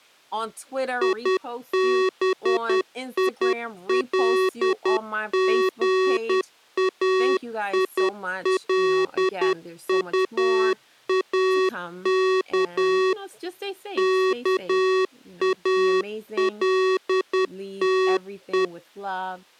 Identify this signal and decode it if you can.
Morse code, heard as electronic beeps, machine-sent, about 10 wpm, 380 Hz, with speech in English. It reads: IBILGAILUAK KALTE